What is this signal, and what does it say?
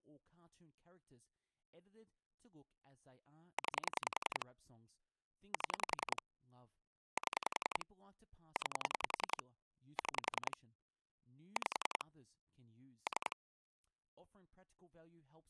Pulse dialling, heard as clicks on a phone line, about 10 pulses a second, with speech in English. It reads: 9 7 7 9 6 5 3